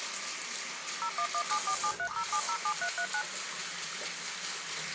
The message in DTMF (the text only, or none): 01174730707339